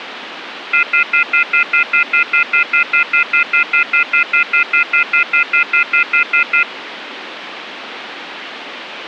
Telephone call progress tone (North American plan), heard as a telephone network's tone, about 1400, 2050, 2450, 2600 Hz, 0.1 s on and 0.1 s off, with phone line noise. Off-hook warning tone.